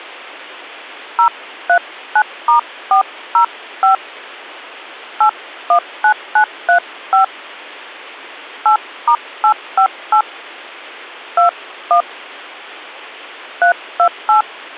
DTMF, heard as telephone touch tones, dialled by hand, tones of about 100 ms. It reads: 039*405 819935 8*858 21 328